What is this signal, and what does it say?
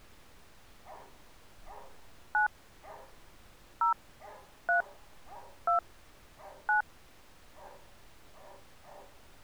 DTMF, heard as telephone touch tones, dialled by hand, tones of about 120 ms, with street noise. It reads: 9 0 3 2 9